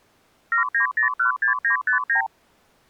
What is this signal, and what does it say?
Multi-frequency trunk signalling (R2, with the far end's replies), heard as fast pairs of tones, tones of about 110 ms. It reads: 79016959